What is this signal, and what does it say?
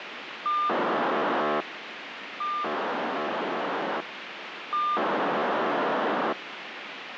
POCSAG pager data (2400 baud), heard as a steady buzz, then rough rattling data, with radio hiss.